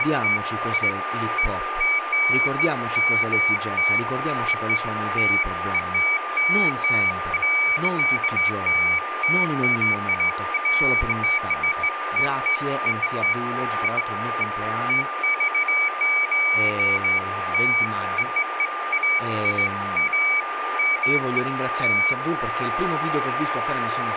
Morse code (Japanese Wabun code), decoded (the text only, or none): none